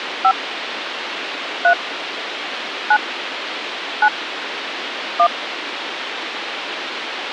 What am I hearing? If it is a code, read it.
DTMF, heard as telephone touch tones, dialled by hand, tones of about 80 ms, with radio hiss. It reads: 5 3 9 9 1